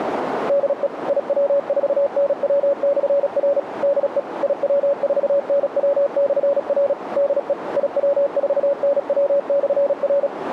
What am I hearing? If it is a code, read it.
Morse code, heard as a keyed tone, machine-sent, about 36 wpm, 560 Hz, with radio static and a narrow filter. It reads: DE IW4NW/R DE IW4NW/R DE IW4NW/R